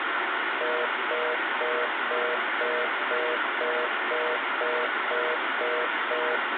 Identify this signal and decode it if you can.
Telephone call progress tone (North American plan), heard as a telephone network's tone, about 480, 620 Hz, 0.25 s on and 0.25 s off, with phone line noise. Congestion tone.